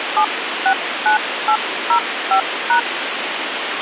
DTMF, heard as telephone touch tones, dialled by hand, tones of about 100 ms, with radio hiss. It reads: 769805#